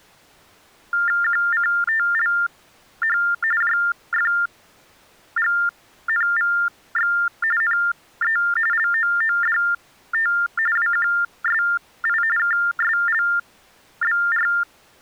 TTY/TDD text telephone tones (45.45 baud Baudot), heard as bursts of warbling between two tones, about 400 Hz shift, 1600 Hz centre. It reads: QCTLH JFGNVX NE LOODT WQSI KSLBR